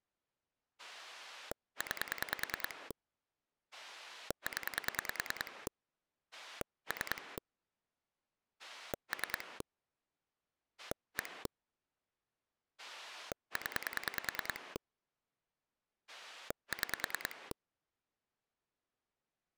Pulse dialling, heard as a rotary dial, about 10 pulses a second. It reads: 9 0 3 3 1 0 6